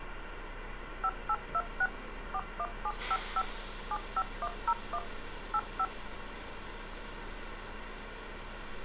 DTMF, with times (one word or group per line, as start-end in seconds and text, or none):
1.0-1.9 5826
2.3-3.4 41755
3.9-5.0 75101
5.5-5.8 85